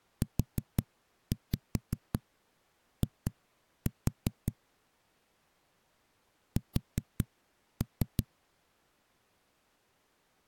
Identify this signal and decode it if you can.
Tap code, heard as knocks on a wall, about 5 knocks a second. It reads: UI S